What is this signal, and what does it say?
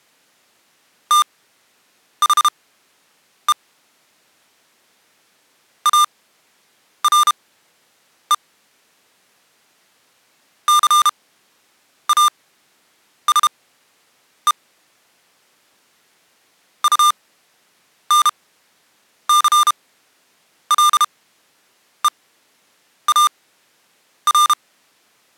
Morse code, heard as electronic beeps, machine-sent, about 32 wpm, spaced as for 8 wpm, 1200 Hz. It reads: THE ARE CASE UNCLEAR